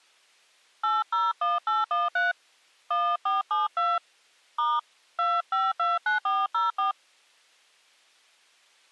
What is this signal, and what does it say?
DTMF, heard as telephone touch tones, dialled by hand, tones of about 190 ms. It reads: 801813 1472 * 2529404